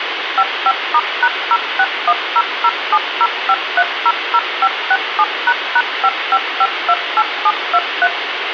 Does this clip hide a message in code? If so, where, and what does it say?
Yes: DTMF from 0.4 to 8.1 s, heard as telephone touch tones, dialled by machine, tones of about 50 ms, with radio hiss. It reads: 55*#06100705300567##55528723